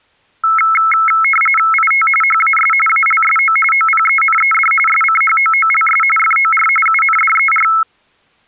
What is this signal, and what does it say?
RTTY (45.45 baud, 850 Hz shift), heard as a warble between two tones, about 1750 Hz centre. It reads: IT HAS ALSO OPENED SCHOOLS FOR UNDER